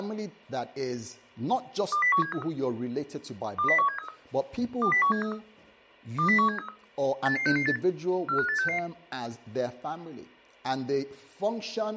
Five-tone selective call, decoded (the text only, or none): 20173 20173 20173 20173 88668 45866